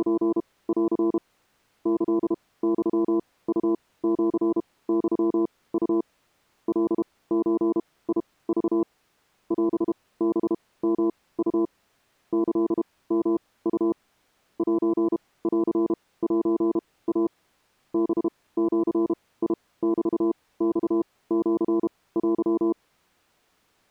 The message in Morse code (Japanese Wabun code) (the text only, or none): … キユウシユウ カゾク オハヨウ キヨウ センセイ ハジメマシテ